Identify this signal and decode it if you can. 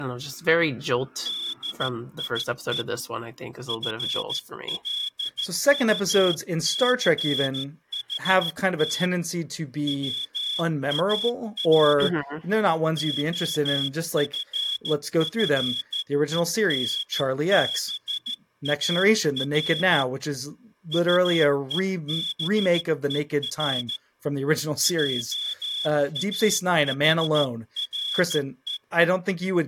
Morse code, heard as a whistle, hand-sent with a straight key, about 14 wpm, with speech in English. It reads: DIE FLUCHT WAR OFFENBAR UEBER JAHRE